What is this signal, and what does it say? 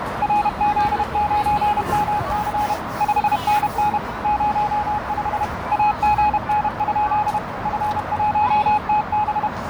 Morse code, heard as a keyed tone, machine-sent, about 31 wpm, 840 Hz, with radio static, a narrow filter and the noise of a park. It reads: RZ9MC 5NN 05 AGN? F1TB